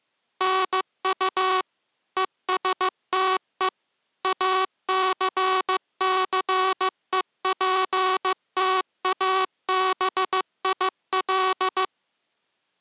Morse code, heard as a buzzer, machine-sent, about 15 wpm. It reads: NU ESTE ACCEPTABIL